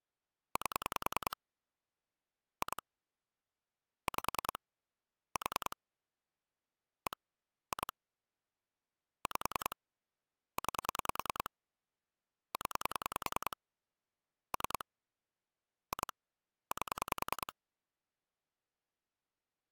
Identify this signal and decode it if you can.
Pulse dialling, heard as clicks on a phone line, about 10 pulses a second. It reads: 8 2 5 4 1 2 5 9 0 3 2 8